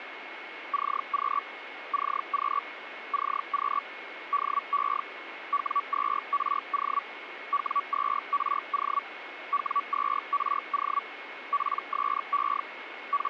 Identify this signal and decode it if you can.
Hellschreiber (Feld-Hell, 122.5 baud), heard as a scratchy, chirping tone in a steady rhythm, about 1140 Hz, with radio static and a steady whistle near 2180 Hz. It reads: CQ CQ CQ DE W2RO W2RO W2RO PSE …